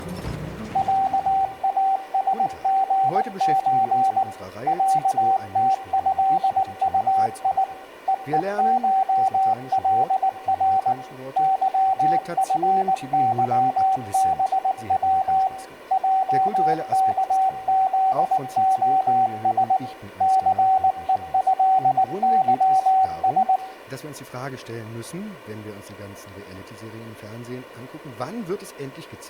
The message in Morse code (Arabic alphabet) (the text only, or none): عاسغز عتهطي ءءشلر ظفظبو جكذخس ثءهظس